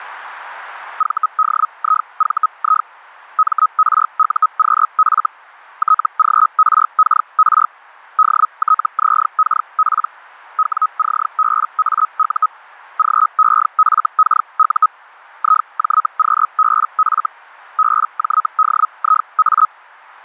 Hellschreiber (Feld-Hell, 122.5 baud), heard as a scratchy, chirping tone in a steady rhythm, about 1270 Hz. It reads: VDIVI MRUQF TGRKR DTZKP WCBAU GEFKU IJQBF BJDIA